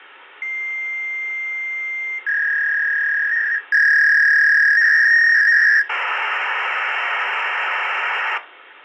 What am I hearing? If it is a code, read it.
Fax machine handshake, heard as a long tone, a warble and hiss, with phone line noise.